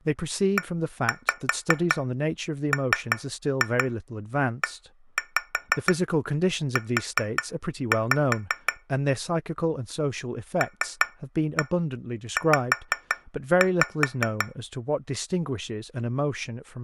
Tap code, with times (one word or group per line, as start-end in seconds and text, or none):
0.6-8.7 EMEU
10.6-14.5 LZ